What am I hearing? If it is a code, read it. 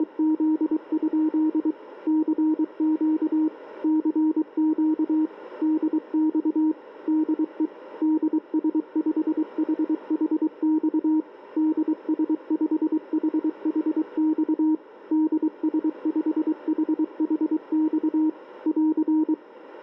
Morse code, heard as a keyed tone, machine-sent, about 23 wpm, 310 Hz, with radio static. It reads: … CQ CQ DX DE DS5HHX DS5HHX DS5HHX <AR>